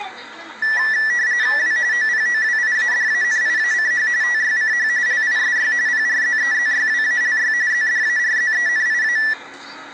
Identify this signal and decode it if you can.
RTTY (45.45 baud, 170 Hz shift), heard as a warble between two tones, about 1850 Hz centre, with the noise inside a bus. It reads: W OPOWIADANIACH TYCH LISY PRZEZYWALY ZDARZENIA